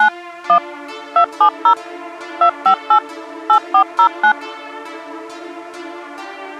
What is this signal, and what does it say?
DTMF, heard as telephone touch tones, dialled by machine, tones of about 90 ms. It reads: 9 1 270 258 8409